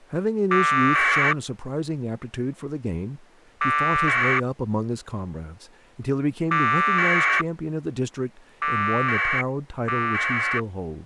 Packet radio (AX.25, as in APRS), 1200 baud, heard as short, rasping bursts, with speech in English.